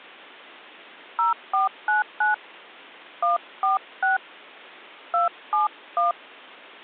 DTMF, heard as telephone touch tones, dialled by hand, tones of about 140 ms. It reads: 0499 146 271